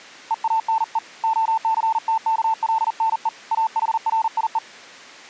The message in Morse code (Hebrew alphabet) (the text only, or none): ואנו הסתכלנו אחריו